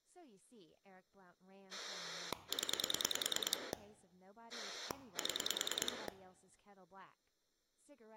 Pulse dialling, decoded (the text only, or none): 0 7